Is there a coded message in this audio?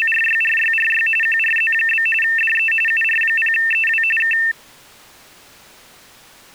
Yes: RTTY (45.45 baud, 850 Hz shift) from 0.0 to 4.5 s, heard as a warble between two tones, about 2250 Hz centre. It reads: … QRZ? DE UR0EW K